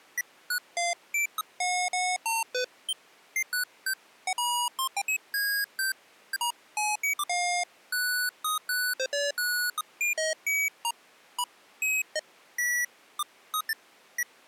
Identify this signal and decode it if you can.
Electronic bleeps of random pitch and length. There is no code.